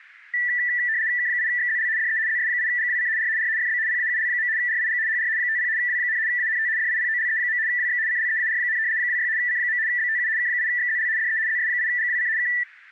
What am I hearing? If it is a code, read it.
RTTY (75 baud, 170 Hz shift), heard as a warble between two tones, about 1850 Hz centre. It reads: K8XZL DE ZS8GWC R R FB PAUL. RIG HR 50 W, ANT DIPOLE. WX CLEAR, 26 C. BTU K8XZL DE ZS8GWC K